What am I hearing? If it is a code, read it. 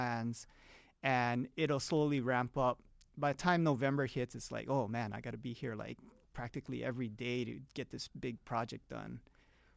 Speech in English. There is no code.